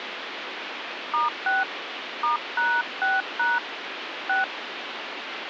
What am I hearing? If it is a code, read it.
DTMF, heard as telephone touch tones, dialled by hand, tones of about 180 ms, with phone line noise. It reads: *6 *#6# 6